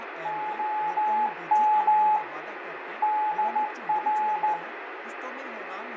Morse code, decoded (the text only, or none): OM DR